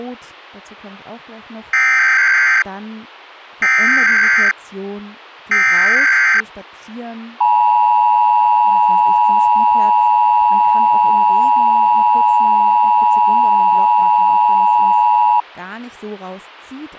Emergency Alert System (SAME) tones (header bursts, then the 853 and 960 Hz attention tone), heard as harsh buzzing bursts, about 520.83 baud, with speech in German.